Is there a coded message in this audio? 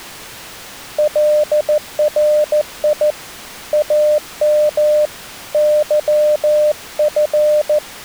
Yes: Morse code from 0.9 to 7.8 s, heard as a keyed tone, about 14 wpm, 600 Hz. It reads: LRI AM YF